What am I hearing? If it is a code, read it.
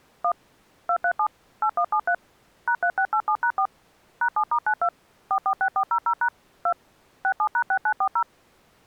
DTMF, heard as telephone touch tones, dialled by machine, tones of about 70 ms. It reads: 1 237 8173 #3687#4 #7*92 446400# 2 67#6940